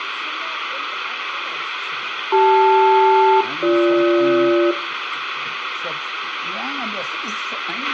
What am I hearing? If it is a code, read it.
Aircraft SELCAL, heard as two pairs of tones, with radio hiss, a squelch burst at the end and room echo. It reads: CL-BG